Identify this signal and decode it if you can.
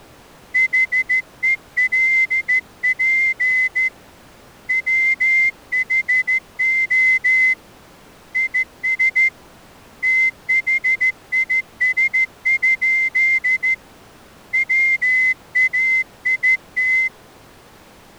Morse code, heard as a whistle, hand-sent with a straight key, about 14 wpm. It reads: HELP WHO IS THIS? WAIT